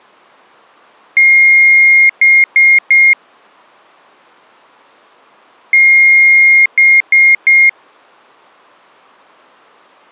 Beep code, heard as beeps from a small speaker, played twice, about 2150 Hz. 1 long, 3 short. In Award and IBM BIOS tables: video adapter failure; in AMI BIOS tables: memory failure.